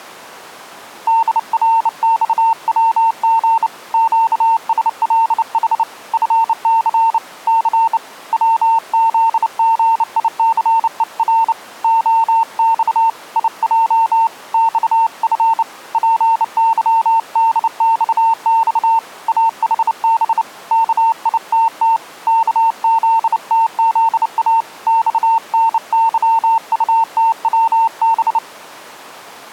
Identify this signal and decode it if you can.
Morse code, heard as a keyed tone, hand-sent with a bug key, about 29 wpm, 900 Hz. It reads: DRXWG QSLH FC C WZGICER OX IJ XF PYDXX AHB KITT KZTZA XNYUTWB